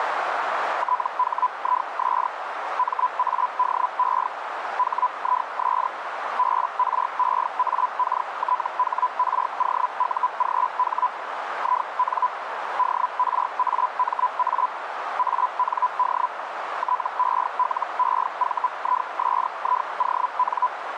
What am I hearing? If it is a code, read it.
Hellschreiber (Feld-Hell, 122.5 baud), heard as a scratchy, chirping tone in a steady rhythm, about 1000 Hz, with radio static and a narrow filter. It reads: THIS MADE HIS BREAKTHROUGH IN DRAMA AND TELEVISION